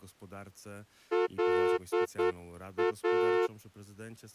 Morse code, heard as a horn, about 9 wpm. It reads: LA